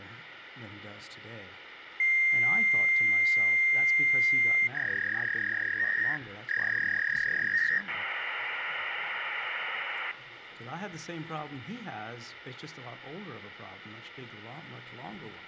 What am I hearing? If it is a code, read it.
Fax machine handshake, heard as a long tone, a warble and hiss, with phone line noise.